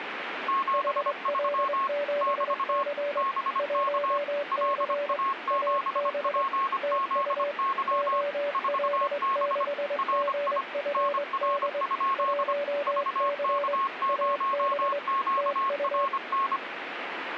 Morse code, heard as two keyed tones, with radio static. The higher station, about 25 wpm, 1090 Hz: 73 <BT> BK LA7PZY 4B RI NR? VK0QRN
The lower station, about 23 wpm, 580 Hz: HL7C 1C AB TU OL6GFD 1C AB TU